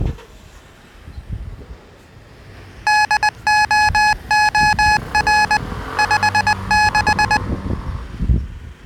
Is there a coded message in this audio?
Yes: Morse code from 2.8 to 7.4 s, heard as electronic beeps, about 20 wpm, 850 Hz, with the noise of a residential street. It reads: DOOR 56